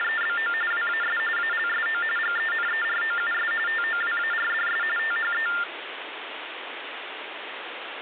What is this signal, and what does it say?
TTY/TDD text telephone tones (45.45 baud Baudot), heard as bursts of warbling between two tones, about 400 Hz shift, 1600 Hz centre, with phone line noise. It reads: … WAS ALSO GENEROUS TOWARDS THE